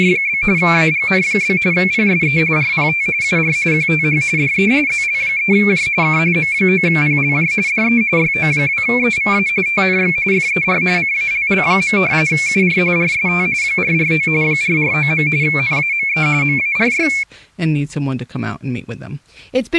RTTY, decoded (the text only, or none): … AGN? PSE RPT UR QTH DE ZL3J K M9PLJ DE YO2EVA TNX FER CALL. UR RST 449 449. NAME MARY